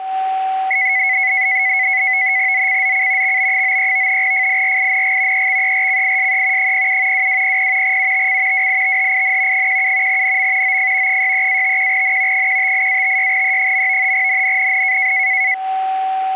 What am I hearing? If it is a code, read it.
NAVTEX (SITOR-B), 100 baud, 170 Hz shift, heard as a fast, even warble, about 2100 Hz centre, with a steady whistle near 760 Hz. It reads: ZCZC XB93 FIRING EXERCISE 07 2200 UTC WITHIN 17 NM OF 63-51N 158-56E. NNNN